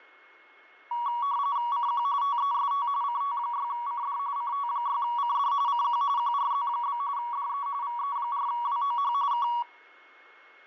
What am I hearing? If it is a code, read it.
RTTY (45.45 baud, 170 Hz shift), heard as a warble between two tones, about 1040 Hz centre, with a steady whistle near 2170 Hz. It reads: CQ TEST CT6CD CT6CD CQ QRZ? DE VE4WOH K